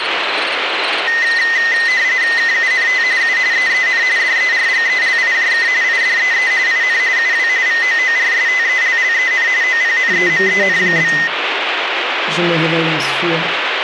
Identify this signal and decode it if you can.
RTTY (45.45 baud, 170 Hz shift), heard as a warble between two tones, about 1950 Hz centre, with radio static. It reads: KUNT U EEN DERGELIJK IDEE IN UW VOORSTELLEN OPNEMEN?